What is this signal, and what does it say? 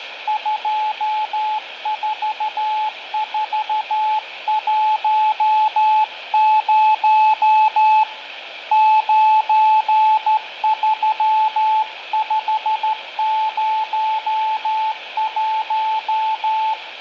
Morse code, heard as a keyed tone, hand-sent with a straight key, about 13 wpm, 870 Hz, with radio static, fading and room echo. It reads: 24410 93501